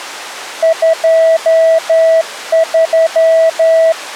Morse code, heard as a keyed tone, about 11 wpm, 650 Hz. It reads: 23